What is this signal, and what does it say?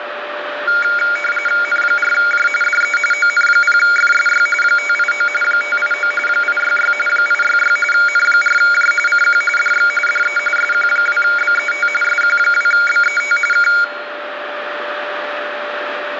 RTTY (45.45 baud, 850 Hz shift), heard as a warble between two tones, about 1850 Hz centre, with radio static and a steady whistle near 590 Hz. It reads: N4J DE ON0FSY 589 589 866 866 N4J CQ DX DE SQ2BET SQ2BET K